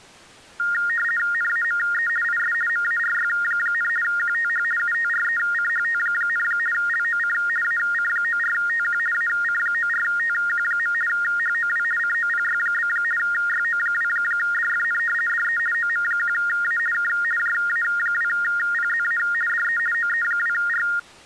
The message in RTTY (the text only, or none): NAME IS MARY, QTH UTRECHT, LOC AC94TQ AC94TQ. HOW COPY? YO2DFN DE OM1A K JA2PZA DE OE2R